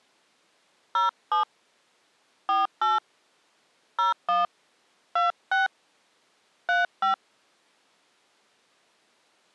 DTMF, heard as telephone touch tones, dialled by hand, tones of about 160 ms. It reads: 07 48 01 26 35